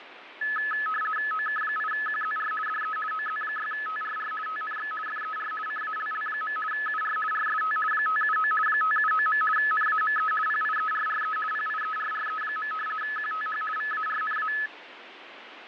RTTY (50 baud, 450 Hz shift), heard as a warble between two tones, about 1500 Hz centre, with radio static and fading. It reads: OK8QZR DE OZ6TRR TNX FER CALL. UR RST 579 579. NAME PIERRE PIERRE. QTH VARNA